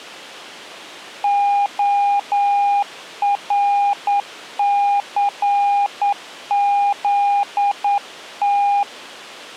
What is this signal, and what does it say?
Morse code (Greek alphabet), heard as a keyed tone, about 9 wpm, 810 Hz. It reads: ΟΡΘΖΤ